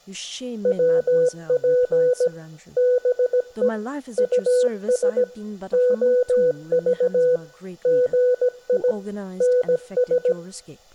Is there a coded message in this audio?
Yes: Morse code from 0.6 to 10.4 s, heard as a keyed tone, machine-sent, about 17 wpm, 500 Hz, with speech in English. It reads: WP BE US OV GI NS